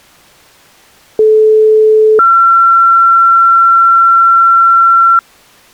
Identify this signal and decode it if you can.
Two-tone page, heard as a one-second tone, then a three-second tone, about 430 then 1360 Hz.